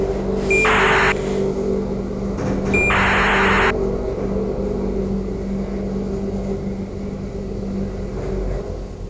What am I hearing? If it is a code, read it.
ACARS aircraft data, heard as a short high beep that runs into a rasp, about 2400 baud, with the noise inside a lift.